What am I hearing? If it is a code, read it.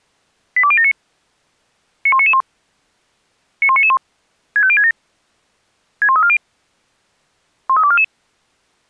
Five-tone selective call (ZVEI), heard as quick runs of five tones, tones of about 70 ms. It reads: 82079 91991 91991 65067 61340 13244